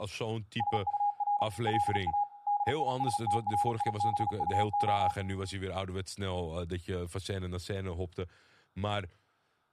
Morse code, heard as a keyed tone, machine-sent, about 36 wpm, 820 Hz, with room echo and speech in Dutch. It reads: SUR LA DISTRIBUO